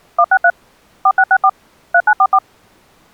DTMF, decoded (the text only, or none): 163 4664 3944